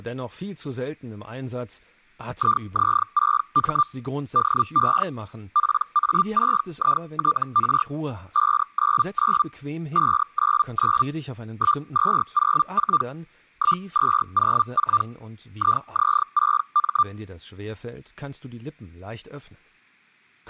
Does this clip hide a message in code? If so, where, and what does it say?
Yes: Hellschreiber (Feld-Hell, 122.5 baud) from 2.3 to 17.0 s, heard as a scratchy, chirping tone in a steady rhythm, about 1190 Hz, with speech in German. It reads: IZ6M DE PA6ITR 599 599 1204 1204 IZ6M